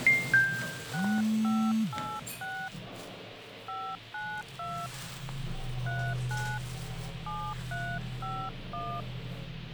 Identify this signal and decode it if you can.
DTMF, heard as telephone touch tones, dialled by hand, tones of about 270 ms, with radio hiss and the noise inside a lift. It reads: 6586 592 39 7351